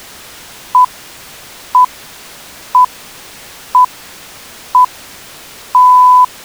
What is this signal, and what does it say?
Radio time signal (six pips, as the Greenwich Time Signal), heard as pips.